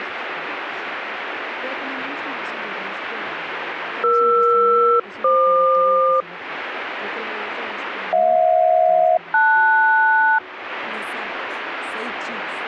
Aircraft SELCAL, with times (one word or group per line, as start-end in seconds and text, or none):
4.0-6.2 ER-FQ
8.1-10.4 HJ-LS